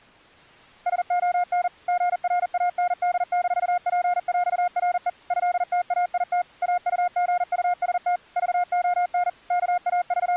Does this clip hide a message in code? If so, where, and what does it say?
Yes: Morse code (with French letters) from 0.8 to 10.4 s, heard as a keyed tone, machine-sent, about 40 wpm, 710 Hz. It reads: SON GRAND-PÈRE ÉTAIT AUGUST VON …